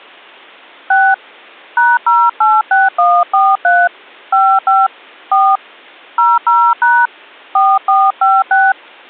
DTMF, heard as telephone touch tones, dialled by hand, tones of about 220 ms. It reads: 6 #086143 55 4 00# 4456